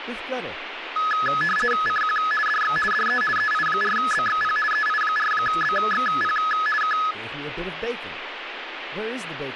RTTY (50 baud, 450 Hz shift), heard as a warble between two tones, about 1490 Hz centre, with radio static and speech in English. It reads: CQ DX DE EI4BXP EI4BXP K